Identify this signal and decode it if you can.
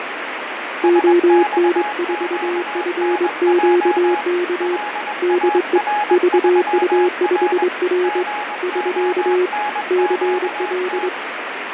Morse code, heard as two keyed tones, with radio static and fading. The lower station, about 23 wpm, 360 Hz: ON4FQK DE VU5R <SK> CL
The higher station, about 21 wpm, 840 Hz: SXQNJ LAR3R GONQT